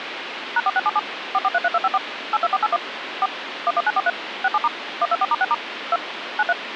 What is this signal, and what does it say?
DTMF, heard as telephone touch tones, dialled by machine, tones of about 40 ms, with phone line noise. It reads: #4677 4433254 82481 4 11943 67* 124*6* 2 93